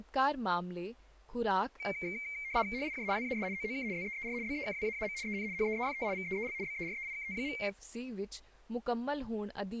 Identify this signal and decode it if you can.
RTTY (75 baud, 170 Hz shift), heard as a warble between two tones, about 2200 Hz centre, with speech in Punjabi. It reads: HIJ WAS OOK ZEER BEKWAAM EN HEEFT VEEL BEREIKT.